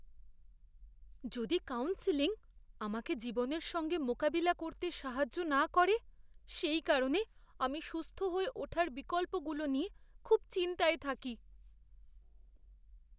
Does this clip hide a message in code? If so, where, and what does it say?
No, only speech in Bangla.